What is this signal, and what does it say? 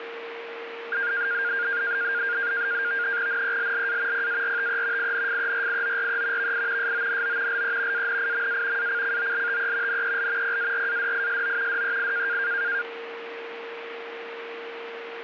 NAVTEX (SITOR-B), 100 baud, 170 Hz shift, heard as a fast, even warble, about 1500 Hz centre, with radio static and a steady whistle near 460 Hz. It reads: NELLA PARTE INFERIORE VI SONO LE ANIMA ACCOLTE NEL PARADISO DEI